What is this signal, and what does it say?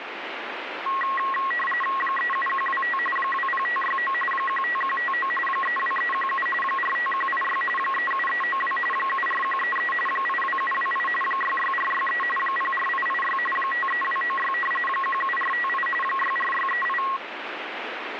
RTTY (45.45 baud, 850 Hz shift), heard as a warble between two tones, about 1500 Hz centre, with radio static. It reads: 37125 20569 15159 32317 45186 37392 74133 82728 66463 04886 53296 17458 64638